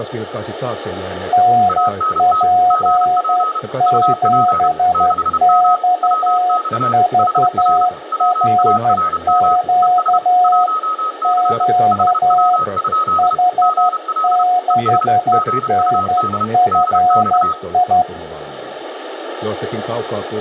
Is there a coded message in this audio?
Yes: Morse code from 1.3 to 18.1 s, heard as two keyed tones, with radio static. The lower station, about 12 wpm, 720 Hz: NP7XVRQ Q H6NFI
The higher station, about 31 wpm, 1260 Hz: ANT GP UP 6M WX HR WARM ES 1C HW? GL ES GUD DX